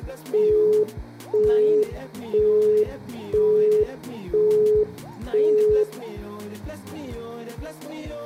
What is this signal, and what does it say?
Telephone call progress tone (single-tone plan, as in Europe, Japan and elsewhere), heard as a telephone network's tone, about 420 Hz, 0.5 s on and 0.5 s off, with room echo. Busy tone.